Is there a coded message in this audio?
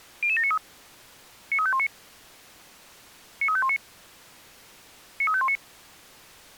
Yes: five-tone selective call (ZVEI) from 0.2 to 5.6 s, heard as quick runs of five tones, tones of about 70 ms. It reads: 00793 93519 93519 93519